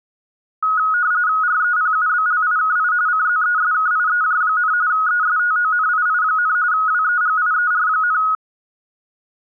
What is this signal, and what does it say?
RTTY (45.45 baud, 170 Hz shift), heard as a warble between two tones, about 1360 Hz centre. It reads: REPUBLIKI CZESKIEJ, ESTONII, WEGIER,